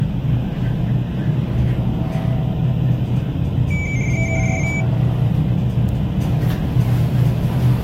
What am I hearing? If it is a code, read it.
RTTY (75 baud, 170 Hz shift), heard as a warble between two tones, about 2200 Hz centre, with radio static, room echo and the noise inside a lift. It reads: VARA